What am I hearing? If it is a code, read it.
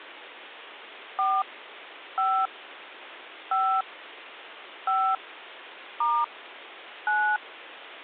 DTMF, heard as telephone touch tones, dialled by hand, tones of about 280 ms. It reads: 4 5 5 5 * 9